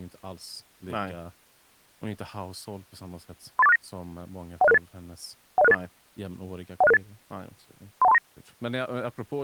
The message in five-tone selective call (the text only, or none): 38469 10668 10668 10668 31239